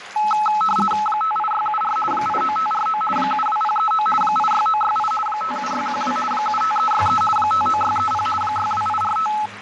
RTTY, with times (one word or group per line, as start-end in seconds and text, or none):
1.1-2.0 58674
2.1-3.0 89549
3.2-4.1 72039
4.2-5.1 86968
5.3-6.2 57612
6.3-7.2 75363
7.4-8.3 59630
8.4-9.3 62845